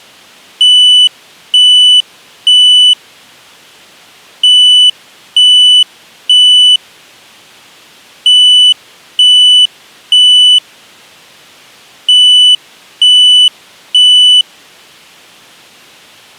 Alarm pattern, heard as an alarm's beeps, played four times, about 3000 Hz. Temporal three. Smoke or fire, evacuate.